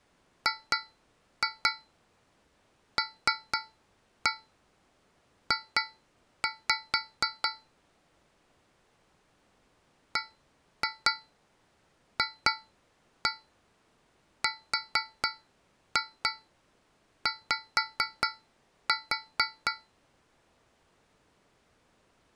Tap code, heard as taps on a metal pipe, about 4 knocks a second. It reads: GLJ BFRY